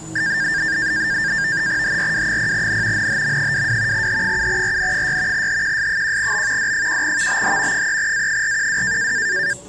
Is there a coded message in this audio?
Yes: NAVTEX (SITOR-B), 100 baud, 170 Hz shift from 0.2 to 9.5 s, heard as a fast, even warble, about 1700 Hz centre, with the noise inside a lift. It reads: HRW0N NHM22 H7RN6 HQS1B D1VBH 3A412